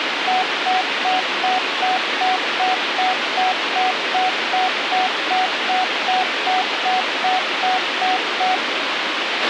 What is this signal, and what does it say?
Evenly repeated beeps, with radio hiss and a squelch burst at the end. There is no code.